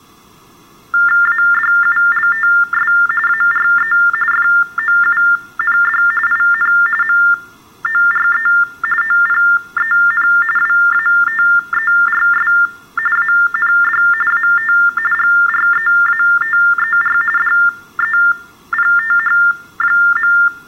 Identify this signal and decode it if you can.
TTY/TDD text telephone tones (45.45 baud Baudot), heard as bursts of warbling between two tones, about 400 Hz shift, 1600 Hz centre. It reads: ADULTS ARE FOUND IN MORE OPEN WATERS AND AT GREATER DEPTH.